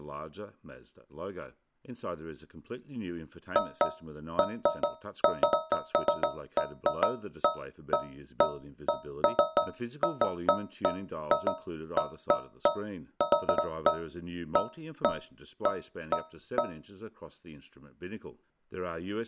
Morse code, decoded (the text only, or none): none